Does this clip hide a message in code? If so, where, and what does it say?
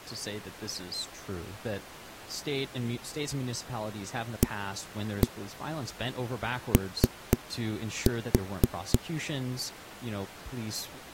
Yes: tap code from 4.4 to 9.0 s, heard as knocks on a wall, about 4 knocks a second, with speech in English. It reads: AO